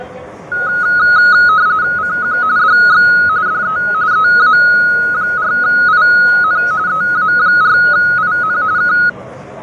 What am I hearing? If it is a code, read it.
RTTY (45.45 baud, 170 Hz shift), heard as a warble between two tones, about 1360 Hz centre, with fading, static crashes and the noise inside a subway train. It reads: CQ DX DE EA4IN EA4IN K